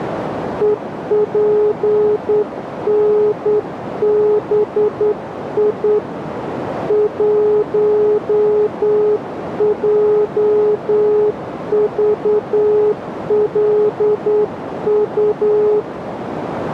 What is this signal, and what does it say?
Morse code, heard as a keyed tone, hand-sent with a straight key, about 9 wpm, 420 Hz, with radio static and a narrow filter. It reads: EPNBI 1JVLU